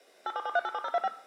DTMF, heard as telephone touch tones, dialled by machine, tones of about 40 ms, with room echo. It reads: 877387025